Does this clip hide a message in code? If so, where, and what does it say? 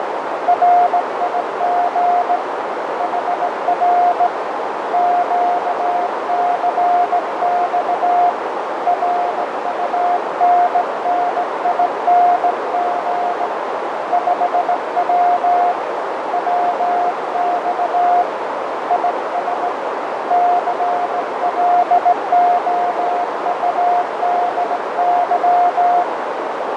Yes: Morse code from 0.4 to 26.1 s, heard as a keyed tone, hand-sent with a straight key, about 17 wpm, 710 Hz, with heavy radio static, fading and a narrow filter. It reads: RIG HR QCX RUNNING 5W WX IS CLOUDY